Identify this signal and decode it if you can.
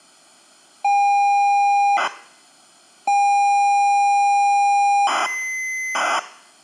ZX Spectrum tape loading, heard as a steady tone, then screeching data.